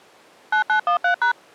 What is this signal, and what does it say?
DTMF, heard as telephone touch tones, dialled by machine, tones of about 100 ms. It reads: 9913#